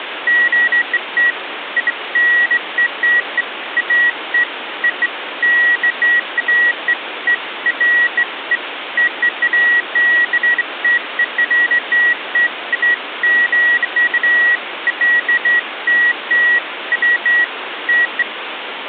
Beeps of irregular length, with phone line noise. There is no code.